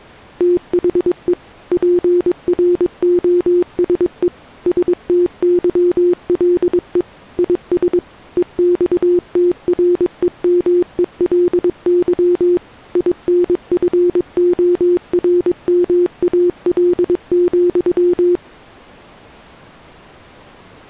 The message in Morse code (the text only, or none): THE PROSE STYLE IS EXTREMELY INFORMAL,